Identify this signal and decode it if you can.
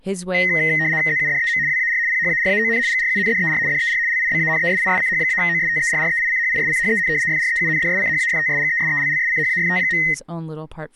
RTTY (75 baud, 170 Hz shift), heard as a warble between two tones, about 1950 Hz centre, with speech in English. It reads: ZUDEM WAR PHARAON GRUNDER DER LIBANESISCH-OSTERREICHISCHEN FREUNDSCHAFTSGESELLSCHAFT.